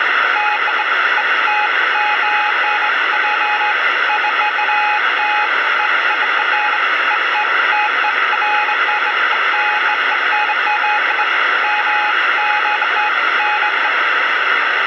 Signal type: none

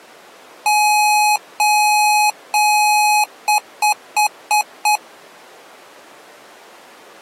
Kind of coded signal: beep code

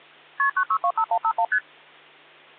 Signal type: multi-frequency trunk signalling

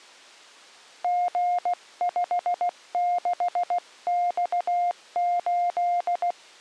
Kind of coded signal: Morse code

